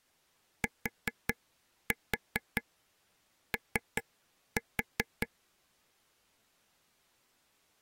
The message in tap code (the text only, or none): TO